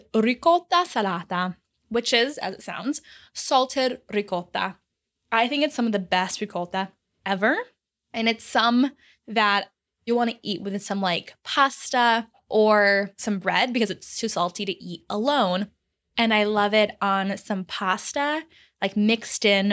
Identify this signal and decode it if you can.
Speech in English. There is no code.